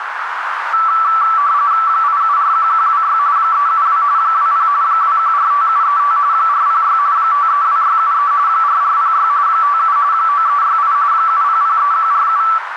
RTTY (45.45 baud, 170 Hz shift), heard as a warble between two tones, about 1240 Hz centre, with radio static and a narrow filter. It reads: 8741126 372 20 2145735 406 532673 4406 57 9368 7003147